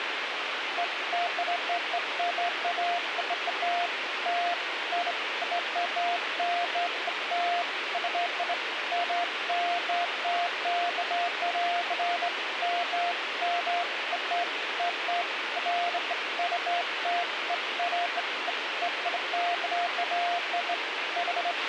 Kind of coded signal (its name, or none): none